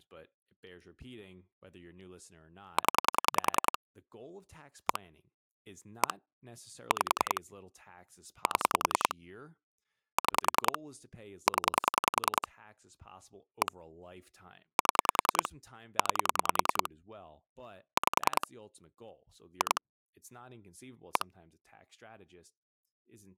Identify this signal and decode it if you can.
Pulse dialling, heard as clicks on a phone line, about 10 pulses a second, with speech in English. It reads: 0 1 1 5 7 6 0 1 7 9 5 2 1